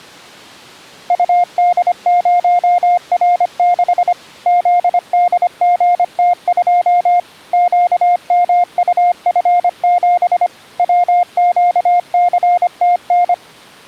Morse code, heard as a keyed tone, machine-sent, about 25 wpm, 710 Hz. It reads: UD0R6 ZDGT2 QMUF7 WQCTN